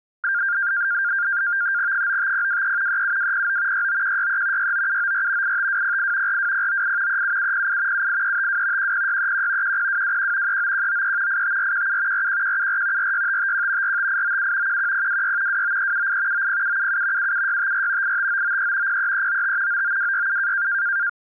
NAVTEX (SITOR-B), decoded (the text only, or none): 95023 37209 69163 69794 85208 42098 37708 78352 10631 10221 39193 85417 41174 46551 45897 11026 29378 90777 77654 85993 03395 99267